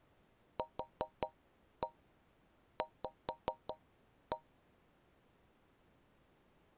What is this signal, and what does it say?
Tap code, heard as taps on a metal pipe, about 5 knocks a second. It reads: QV